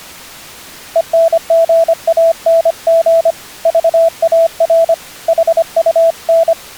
Morse code, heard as a keyed tone, hand-sent with a paddle, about 25 wpm, 660 Hz. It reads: ENGANG VAR HUN